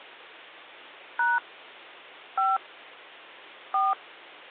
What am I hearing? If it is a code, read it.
DTMF, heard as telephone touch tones, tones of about 190 ms, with hum. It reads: # 5 4